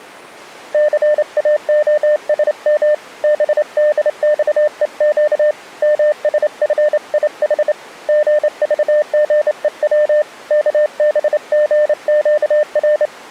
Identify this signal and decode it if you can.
Morse code, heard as a keyed tone, hand-sent with a straight key, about 28 wpm, 600 Hz. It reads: CAOSM BDXEQ MSFIH GVGEW KBGQR